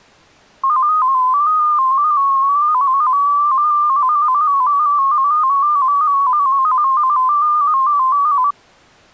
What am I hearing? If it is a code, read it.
Multi-tone FSK (Olivia or MFSK type), about 250 Hz wide, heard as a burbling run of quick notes, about 15.625 baud.